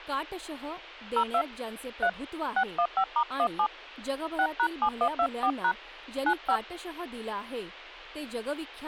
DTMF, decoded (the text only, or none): 02 3 615*17 6#7124# 95